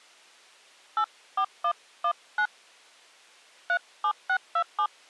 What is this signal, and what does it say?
DTMF, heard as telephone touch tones, dialled by hand, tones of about 80 ms. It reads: 84119 37627